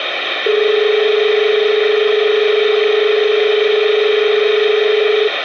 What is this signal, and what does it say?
Telephone call progress tone (as in Australia), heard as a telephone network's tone, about 430 Hz, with phone line noise. Dial tone.